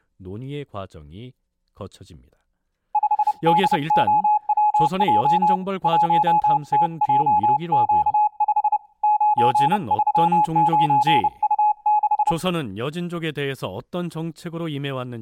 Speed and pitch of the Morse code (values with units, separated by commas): 30 wpm, 840 Hz